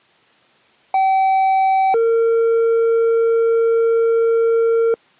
Two-tone page, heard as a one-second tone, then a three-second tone, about 770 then 460 Hz.